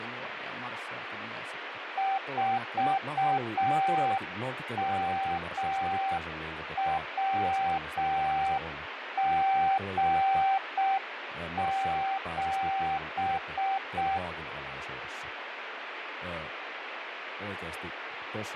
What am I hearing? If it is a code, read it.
Morse code, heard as a keyed tone, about 6 wpm, 780 Hz, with radio static and speech in Finnish. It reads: 4MWG7